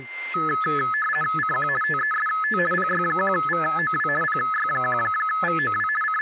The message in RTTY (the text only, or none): CQ TEST PY1VOW PY1VOW …